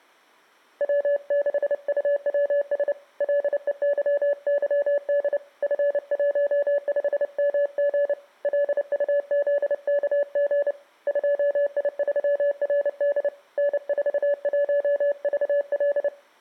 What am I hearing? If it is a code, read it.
Morse code, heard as a keyed tone, hand-sent with a paddle, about 29 wpm, 570 Hz, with room echo. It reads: W6UWS LEYYD F15MG LUZKG 2I3RD N41VL